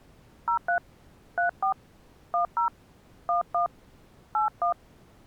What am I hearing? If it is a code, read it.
DTMF, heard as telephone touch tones, dialled by hand, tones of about 110 ms. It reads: 03 34 10 11 81